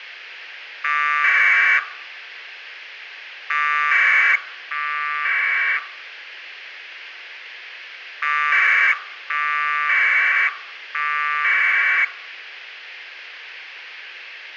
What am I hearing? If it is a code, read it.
Packet radio (AX.25, as in APRS), 1200 baud, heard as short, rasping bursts, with radio hiss.